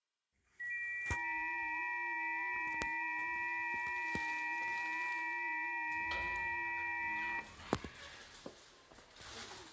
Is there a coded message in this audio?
Yes: FT8 (several signals at once) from 0.6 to 7.4 s, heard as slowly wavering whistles, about 6.25 baud, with room echo and the noise inside a lift.